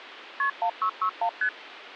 Multi-frequency trunk signalling (R1, as on North American trunks), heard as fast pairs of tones, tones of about 80 ms, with phone line noise. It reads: KP 1661 ST